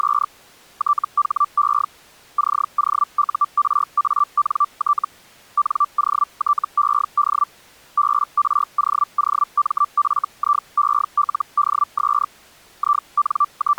Hellschreiber (Feld-Hell, 122.5 baud), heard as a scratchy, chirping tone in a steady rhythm, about 1170 Hz. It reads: … THE COURANT NOTED BROOMFIELDS …